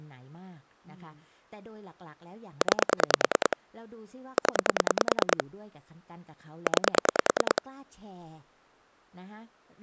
Pulse dialling, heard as clicks on a phone line, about 10 pulses a second, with speech in Thai. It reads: 9 0 9